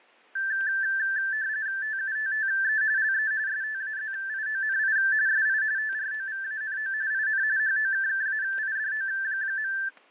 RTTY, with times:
1.8-2.8 TUTTE
3.0-3.3 LE
3.5-5.0 STAZIONI
5.3-5.6 SI
5.8-6.9 TROVANO
7.1-7.4 IN
7.6-9.7 HOKKAIDO.

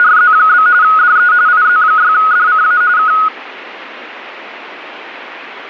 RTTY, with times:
0.0-0.7 …
0.8-1.3 DE
1.5-2.8 IZ6DCA
3.0-3.1 K

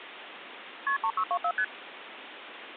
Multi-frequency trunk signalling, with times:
0.9-1.0 KP
1.0-1.5 3624
1.6-1.6 ST

